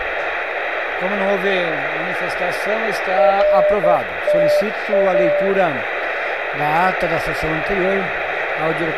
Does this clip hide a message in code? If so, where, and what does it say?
Yes: Morse code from 3.1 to 5.5 s, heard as a keyed tone, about 11 wpm, 600 Hz, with heavy radio static. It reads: RTA